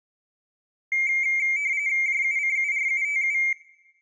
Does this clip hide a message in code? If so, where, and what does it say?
Yes: RTTY (45.45 baud, 170 Hz shift) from 0.9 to 3.5 s, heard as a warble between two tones, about 2200 Hz centre, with room echo. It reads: JUCURUTU